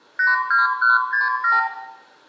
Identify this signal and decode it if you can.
Multi-frequency trunk signalling (R2, with the far end's replies), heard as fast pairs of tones, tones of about 160 ms, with room echo. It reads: 82167